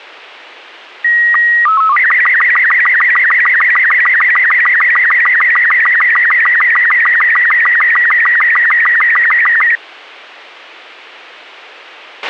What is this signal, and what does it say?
SSTV (slow-scan television), Robot 36, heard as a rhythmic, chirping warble, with a squelch burst at the end.